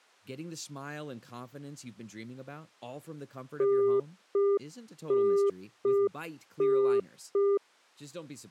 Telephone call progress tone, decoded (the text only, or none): congestion tone